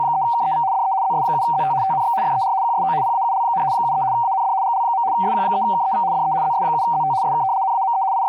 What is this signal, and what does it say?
RTTY (75 baud, 170 Hz shift), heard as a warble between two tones, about 850 Hz centre, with speech in English. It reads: … DE ZS7ZT TNX FER QSO PAUL, 73 AND GL. SQ3KEV DE ZS7ZT SK NAME …